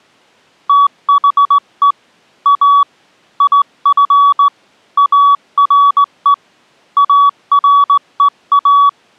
Morse code, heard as a keyed tone, hand-sent with a straight key, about 18 wpm, 1140 Hz. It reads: THE A IF ARE AREA